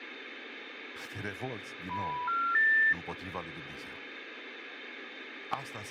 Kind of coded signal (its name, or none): telephone call progress tone